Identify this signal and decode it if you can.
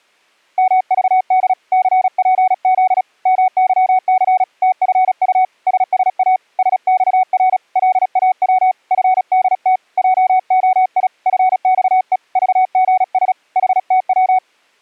Morse code, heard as a keyed tone, hand-sent with a paddle, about 36 wpm, 750 Hz. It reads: MVD CPZ MYC TFU SSA SXR LAW FDT JOI FXE VGS HTW